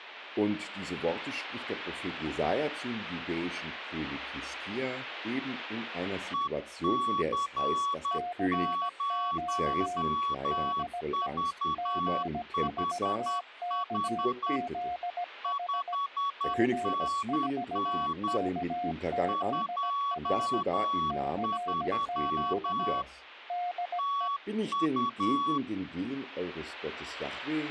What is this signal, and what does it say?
Morse code, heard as two keyed tones. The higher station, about 10 wpm, 1120 Hz: EC0VHH 5NN 23 TU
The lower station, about 17 wpm, 710 Hz: CQ DE G4KZH G4KZH CQ DE